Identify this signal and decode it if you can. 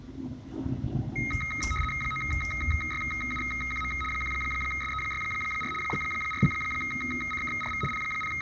RTTY (75 baud, 850 Hz shift), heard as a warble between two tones, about 1700 Hz centre, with room echo and the noise inside a bus. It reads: 9YUQM 1SE64 4CKRV …